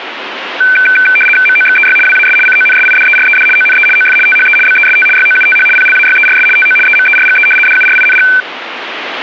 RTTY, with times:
1.5-2.0 MOXEY
2.1-2.4 WAS
2.5-3.5 CONSIDERED
3.6-3.9 ONE
4.0-4.2 OF
4.3-4.6 THE
4.7-5.1 BEST
5.2-5.7 YOUTH
5.8-6.5 PLAYERS
6.6-6.8 TO
6.9-7.5 EMERGE
7.7-8.3 DURING

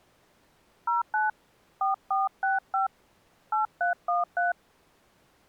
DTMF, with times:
0.9-1.3 09
1.8-2.9 4465
3.5-4.5 8313

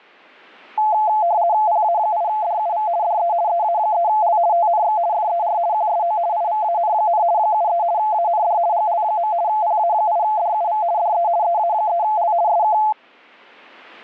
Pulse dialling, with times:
none

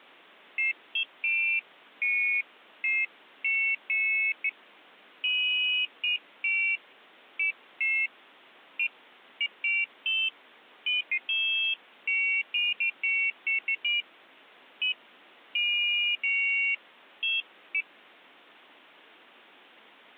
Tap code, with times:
none

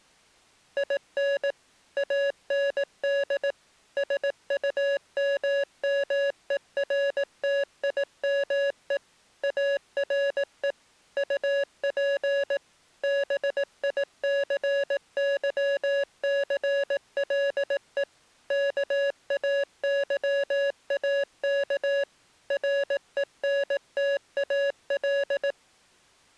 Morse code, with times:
0.8-1.5 IN
2.0-3.5 AND
4.0-9.0 SUMMERTIME
9.4-10.7 ARE
11.2-12.6 UP
13.0-18.0 BICYCLE
18.5-22.0 KAYAK
22.5-25.5 RENTAL

